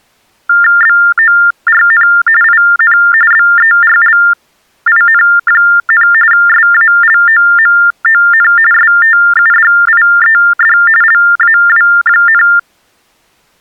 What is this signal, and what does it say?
TTY/TDD text telephone tones (45.45 baud Baudot), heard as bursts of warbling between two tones, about 400 Hz shift, 1600 Hz centre. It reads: BORN IN BERLIN, SALOMON STUDIED LAW,